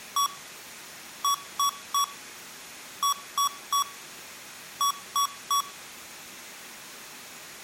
Beep code, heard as beeps from a small speaker, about 1130 Hz. 1-3-3-3.